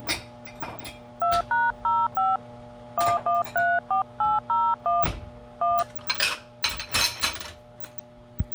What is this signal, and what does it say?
DTMF, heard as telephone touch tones, dialled by hand, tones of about 180 ms, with kitchen noise. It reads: 2#05 1134801 1